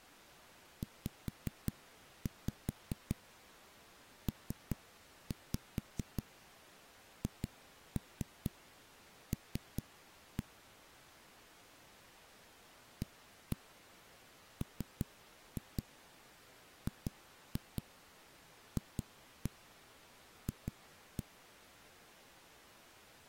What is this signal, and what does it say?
Tap code, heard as knocks on a wall, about 4 knocks a second. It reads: ZPHL AMGFF